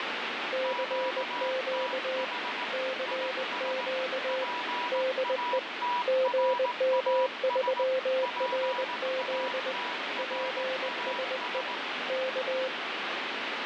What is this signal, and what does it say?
Morse code, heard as two keyed tones, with heavy radio static. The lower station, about 20 wpm, 520 Hz: CQ CQ DE GM3RZ PSE K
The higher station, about 18 wpm, 980 Hz: QTH IS PATRAS PATRAS